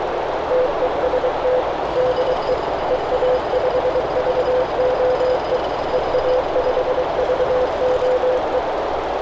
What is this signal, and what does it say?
Morse code, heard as a keyed tone, machine-sent, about 23 wpm, 510 Hz, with heavy radio static, a narrow filter and street noise. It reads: TEST DE EA5VOE EA5VOE